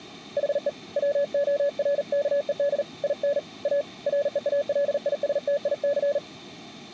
Morse code, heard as a keyed tone, hand-sent with a paddle, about 39 wpm, 570 Hz. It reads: HE WORKED IN A REALISTIC